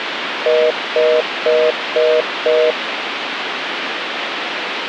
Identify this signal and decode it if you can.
Telephone call progress tone (North American plan), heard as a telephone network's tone, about 480, 620 Hz, 0.25 s on and 0.25 s off, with phone line noise. Congestion tone.